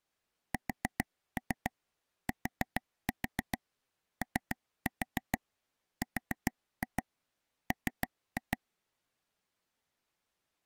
Tap code, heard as taps on a table, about 7 knocks a second. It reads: STORM